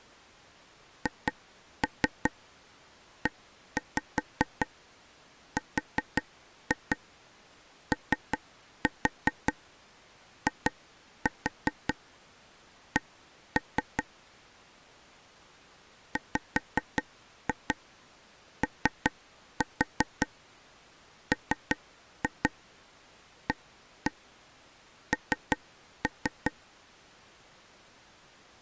Tap code, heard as taps on a table, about 5 knocks a second. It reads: HEROIC WOMAN